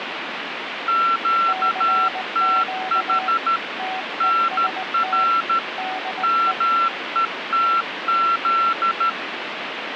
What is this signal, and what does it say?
Morse code, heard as two keyed tones, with radio static. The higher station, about 13 wpm, 1350 Hz: QTH NR METZ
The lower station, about 19 wpm, 750 Hz: CQ TEST DE